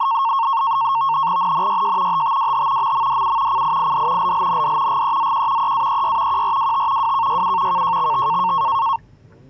NAVTEX (SITOR-B), 100 baud, 170 Hz shift, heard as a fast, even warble, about 1000 Hz centre, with the noise inside a car. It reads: NNYJ HTWH MMDU CIID LLND GEZQ EAEY QRWT WKYU KJXT